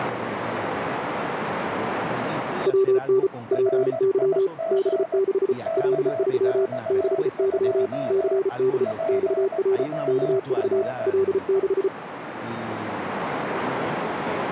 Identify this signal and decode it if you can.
Morse code, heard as two keyed tones, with radio static, a narrow filter and speech in Spanish. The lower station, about 34 wpm, 390 Hz: WN PY B6 L3 6Y CD XR KV L6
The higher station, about 18 wpm, 660 Hz: RIG KX2 PWR